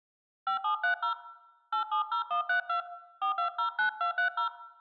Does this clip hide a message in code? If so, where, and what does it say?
Yes: DTMF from 0.5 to 4.5 s, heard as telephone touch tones, dialled by hand, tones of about 110 ms, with room echo. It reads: 5730 870132 4209230